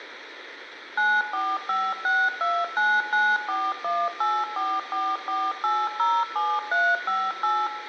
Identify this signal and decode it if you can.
DTMF, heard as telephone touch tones, dialled by machine, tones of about 240 ms, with room echo. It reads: 9456299418444807358